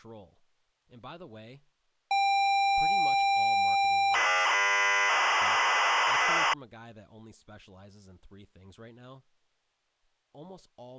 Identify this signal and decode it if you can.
ZX Spectrum tape loading, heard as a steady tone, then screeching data, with speech in English.